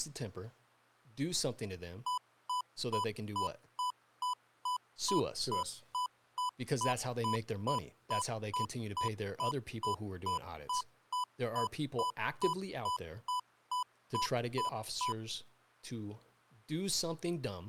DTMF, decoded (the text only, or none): none